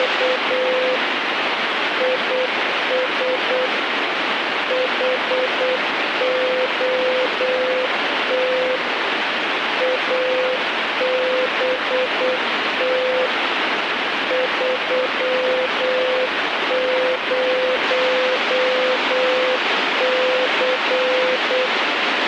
Morse code, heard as a keyed tone, machine-sent, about 8 wpm, 510 Hz, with radio static. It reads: … IS HOT ABT 30C